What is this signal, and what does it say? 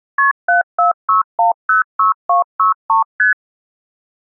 Multi-frequency trunk signalling (R1, as on North American trunks), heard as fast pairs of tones, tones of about 130 ms. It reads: KP 746106263 ST